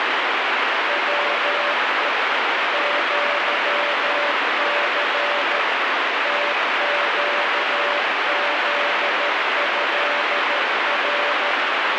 Morse code (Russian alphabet), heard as a keyed tone, machine-sent, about 13 wpm, 580 Hz, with heavy radio static. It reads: ВЕ ЪЦ ТЩЗЭР